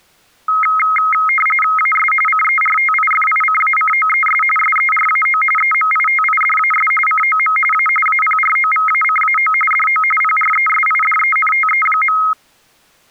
RTTY (45.45 baud, 850 Hz shift), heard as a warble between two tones, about 1700 Hz centre. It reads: AS CERTIFICACOES SERAO EMITIDAS COM A APROVACAO DO PRESIDENTE.